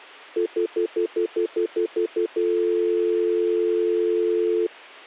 Telephone call progress tone (North American plan), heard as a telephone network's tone, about 350, 440 Hz, 0.1 s on and 0.1 s off. Stutter dial tone.